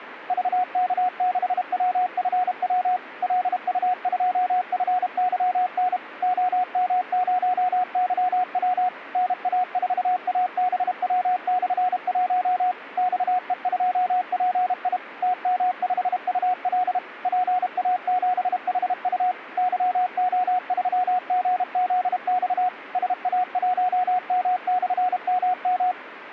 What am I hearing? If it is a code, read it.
Morse code, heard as a keyed tone, machine-sent, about 32 wpm, 730 Hz. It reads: VK6WFW LU2FYN OM0YW NA4ABW/1 XE2PI TM5UL PA7HU YO3GZX SA1M/MM